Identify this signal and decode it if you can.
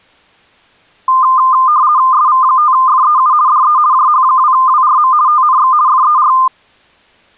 RTTY (50 baud, 170 Hz shift), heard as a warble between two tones, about 1130 Hz centre. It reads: SV5FEU DE JH2WRM TNX FER